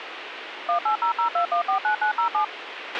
DTMF, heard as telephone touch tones, dialled by machine, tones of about 100 ms, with radio hiss and a squelch burst at the end. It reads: 18002149907